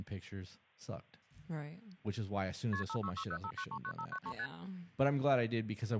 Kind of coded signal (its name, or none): multi-frequency trunk signalling